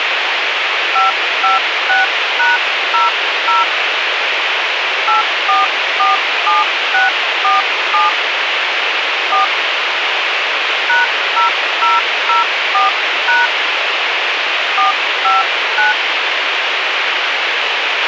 DTMF, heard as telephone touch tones, dialled by hand, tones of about 150 ms, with radio hiss and a squelch burst at the end. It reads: 556#00 8447647 4 #0004# 459